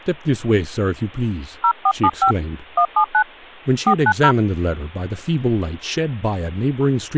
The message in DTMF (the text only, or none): 0475 179 490